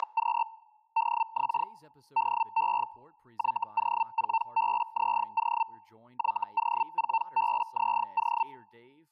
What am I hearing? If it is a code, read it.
Hellschreiber (Feld-Hell, 122.5 baud), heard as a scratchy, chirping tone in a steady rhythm, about 900 Hz, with speech in English. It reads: … DX DE YO4BZO YO4BZO